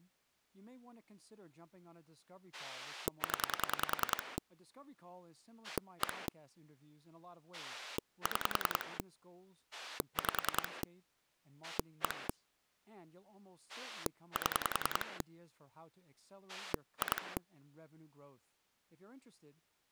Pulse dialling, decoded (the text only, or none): 0 1 6 5 1 7 2